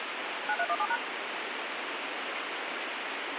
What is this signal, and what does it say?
DTMF, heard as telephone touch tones, dialled by machine, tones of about 60 ms, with radio hiss. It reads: 9317#